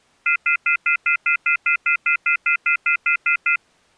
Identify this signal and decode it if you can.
Telephone call progress tone (North American plan), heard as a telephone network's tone, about 1400, 2050, 2450, 2600 Hz, 0.1 s on and 0.1 s off. Off-hook warning tone.